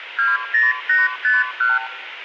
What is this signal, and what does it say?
Multi-frequency trunk signalling (R2, with the far end's replies), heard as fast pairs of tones, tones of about 180 ms, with phone line noise. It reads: 20851